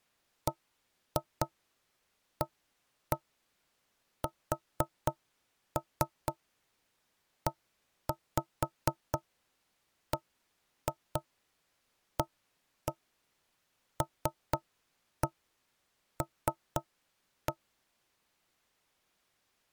Tap code, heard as knocks on wood, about 4 knocks a second. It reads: BASEBALL